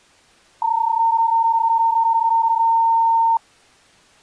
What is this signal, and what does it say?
PSK31 (31.25 baud), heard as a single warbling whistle, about 910 Hz.